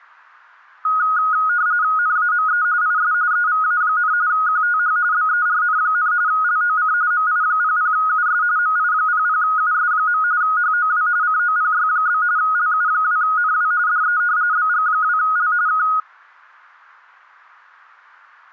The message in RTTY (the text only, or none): NAME IS EVA, QTH BERN, LOC MI00US MI00US. HOW COPY? LU2NW DE BG2L K